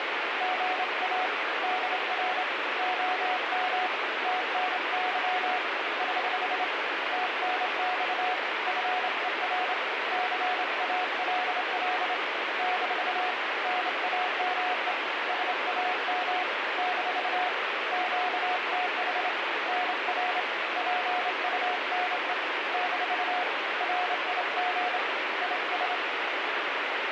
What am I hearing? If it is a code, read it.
Morse code, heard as a keyed tone, hand-sent with a straight key, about 27 wpm, 730 Hz, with heavy radio static. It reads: GA DR OM TNY <HH> TNX FER CALL - NAME SAM - QTH NR PUNE - RIG IS